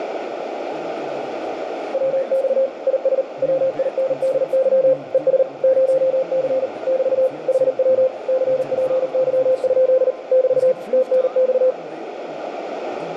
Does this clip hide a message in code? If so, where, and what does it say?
Yes: Morse code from 1.9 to 11.8 s, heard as a keyed tone, machine-sent, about 39 wpm, 520 Hz, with radio static, a narrow filter and room echo. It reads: WX IS WINDY ES 0C <BT> HW CPY? <BT> TNX